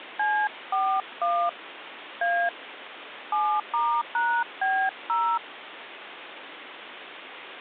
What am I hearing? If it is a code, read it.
DTMF, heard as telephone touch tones, dialled by hand, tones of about 280 ms, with phone line noise. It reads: C41 A 7*#B0